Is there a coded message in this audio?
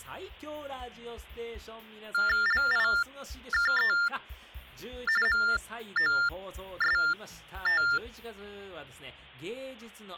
Yes: TTY/TDD text telephone tones (45.45 baud Baudot) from 2.1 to 8.0 s, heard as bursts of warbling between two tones, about 400 Hz shift, 1600 Hz centre. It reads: LIKE MOST